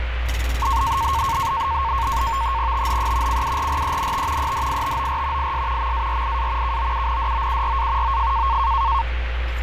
NAVTEX (SITOR-B), 100 baud, 170 Hz shift, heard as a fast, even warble, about 1000 Hz centre, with radio static and street noise. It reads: THE CURRENT EDITOR IS MARIA KOUNDOURA OF